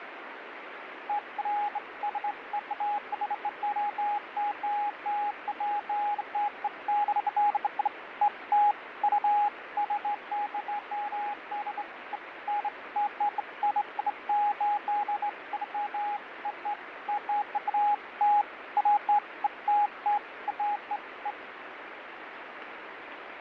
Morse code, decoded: none

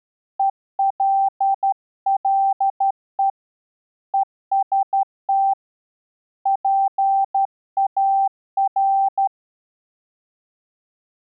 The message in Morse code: ELLE EST PAR

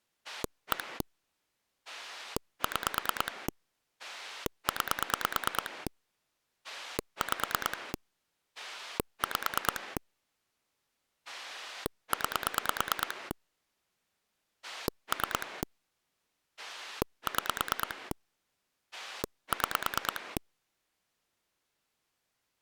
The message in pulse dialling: 1 6 9 5 5 9 3 6 6

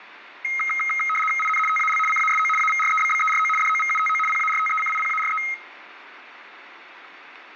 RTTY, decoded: IN TAL CASO AVREBBERO DOVUTO PARTECIPARE

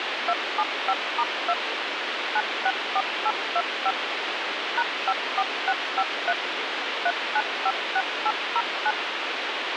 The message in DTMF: 275*2 964825 #54653 3956809

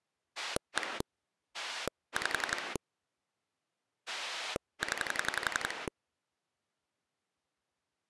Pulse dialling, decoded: 1 5 0

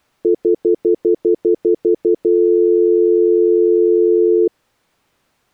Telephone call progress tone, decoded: stutter dial tone

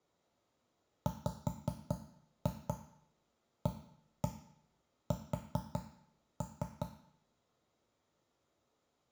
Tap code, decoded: WAS

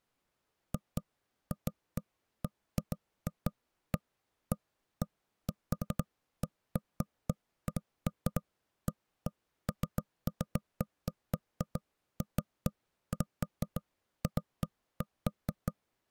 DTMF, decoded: none

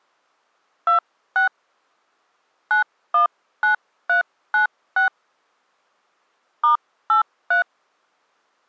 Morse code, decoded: none

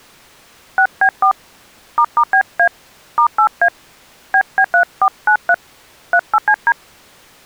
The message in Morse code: none

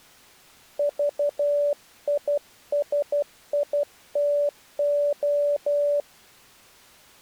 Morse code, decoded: VISITO

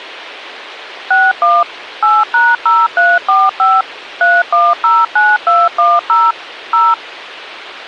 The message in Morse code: none

